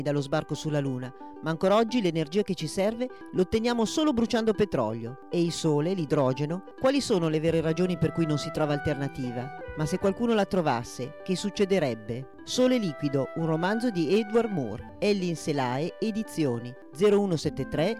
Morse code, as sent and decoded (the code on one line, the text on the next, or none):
none